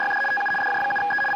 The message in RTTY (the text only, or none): … TU DJ7E …